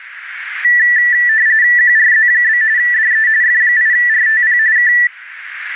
RTTY (45.45 baud, 170 Hz shift), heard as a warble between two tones, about 1850 Hz centre, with radio static. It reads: QRZ? DE F8RTP K